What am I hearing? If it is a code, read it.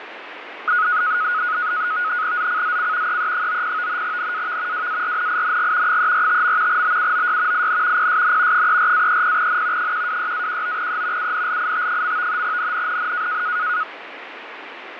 NAVTEX (SITOR-B), 100 baud, 170 Hz shift, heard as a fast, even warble, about 1360 Hz centre, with radio static and fading. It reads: ZCZC EE90 NAV WARNING 345. BUOY IN PSN 34-30N 126-19E UNLIT. NNNN